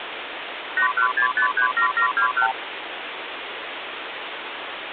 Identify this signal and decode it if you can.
Multi-frequency trunk signalling (R2, with the far end's replies), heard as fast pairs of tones, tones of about 100 ms, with phone line noise. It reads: 816537721